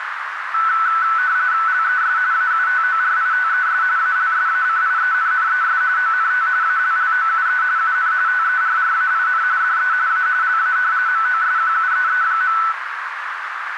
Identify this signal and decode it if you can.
RTTY (45.45 baud, 170 Hz shift), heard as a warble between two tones, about 1410 Hz centre, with radio static and a narrow filter. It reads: LES AUTORITES ALSACIENNES ONT ALLOUE UN TERRAIN DE A LA MOSQUEE.